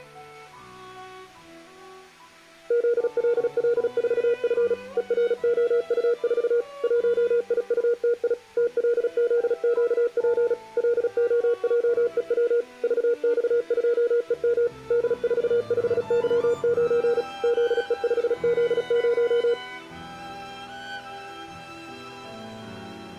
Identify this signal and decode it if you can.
Morse code, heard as a keyed tone, machine-sent, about 36 wpm, 470 Hz. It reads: ZLL4F EROU4 1IUTI TLZQP LOJEW VX2EM D45Y9 ZE5Z0